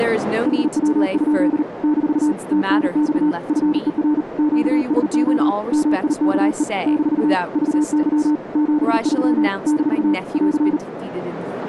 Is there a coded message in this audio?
Yes: Morse code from 0.4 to 10.8 s, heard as a keyed tone, hand-sent with a paddle, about 39 wpm, 300 Hz, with radio static, a narrow filter and speech in English. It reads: HW? - TNX FER QSO MIKE - VY 73 - <AR>